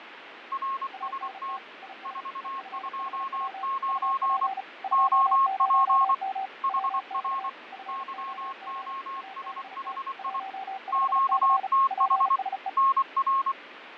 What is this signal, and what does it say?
Morse code, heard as two keyed tones, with radio static and fading. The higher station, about 24 wpm, 1080 Hz: RST 429 OP HR YOSHI QTH NR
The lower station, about 35 wpm, 770 Hz: ANT IS EFHW UP 20M WX FOG ABT 15C PSE